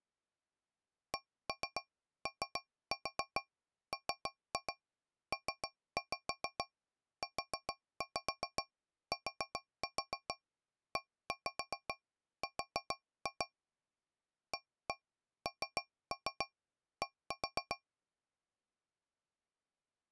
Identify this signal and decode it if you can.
Tap code, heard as taps on a metal pipe, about 7 knocks a second. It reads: COMPUTER AND